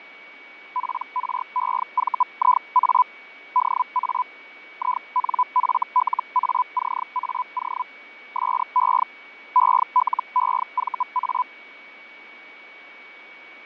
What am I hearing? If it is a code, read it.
Hellschreiber (Feld-Hell, 122.5 baud), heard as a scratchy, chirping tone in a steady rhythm, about 1000 Hz, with fading and a steady whistle near 2250 Hz. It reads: PREVIA DA INFLACAO SE ELEVA